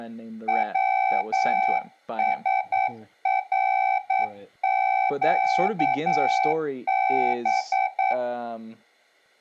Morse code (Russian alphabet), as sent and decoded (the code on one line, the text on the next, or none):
.-- ... .-. --.- -...
ВСРЩБ